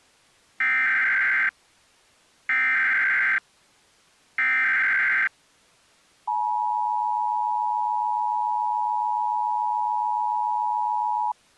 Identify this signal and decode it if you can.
Emergency Alert System (SAME) tones (header bursts, then the 853 and 960 Hz attention tone), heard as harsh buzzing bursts, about 520.83 baud.